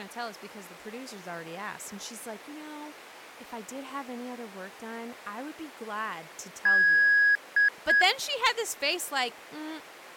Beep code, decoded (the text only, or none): 1 long, 2 short